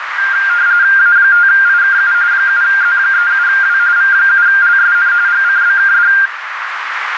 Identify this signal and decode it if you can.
RTTY (45.45 baud, 170 Hz shift), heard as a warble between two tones, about 1500 Hz centre, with radio static and a narrow filter. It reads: A5IKU 7Z37W V7LSN GCBKD